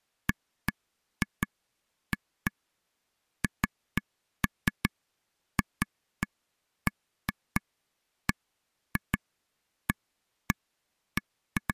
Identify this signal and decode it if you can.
Irregular taps on a table. There is no code.